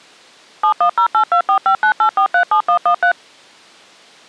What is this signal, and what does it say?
DTMF, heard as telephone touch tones, dialled by machine, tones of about 90 ms. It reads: 710824598437113